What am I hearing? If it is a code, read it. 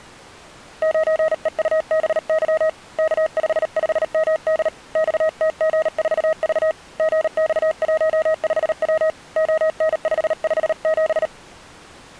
Morse code, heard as a keyed tone, hand-sent with a paddle, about 38 wpm, 630 Hz. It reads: 9EUBY K55MD XTG4V GX15W ON557